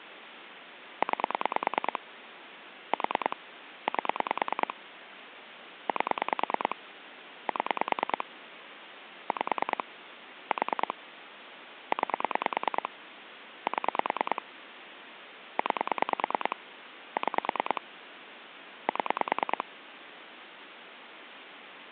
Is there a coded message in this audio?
Yes: pulse dialling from 1.0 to 19.6 s, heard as clicks on a phone line, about 9 pulses a second, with phone line noise. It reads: 9 4 8 8 7 5 4 9 7 9 6 7